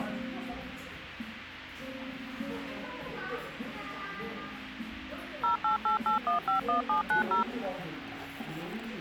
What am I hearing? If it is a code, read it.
DTMF, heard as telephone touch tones, dialled by machine, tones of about 120 ms, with the noise of a cafe. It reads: 0888151790